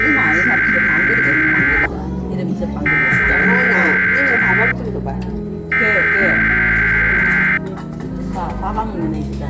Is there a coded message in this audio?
Yes: Emergency Alert System (SAME) tones (header bursts) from 0.0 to 7.6 s, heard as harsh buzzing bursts, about 520.83 baud, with the noise of a crowd indoors.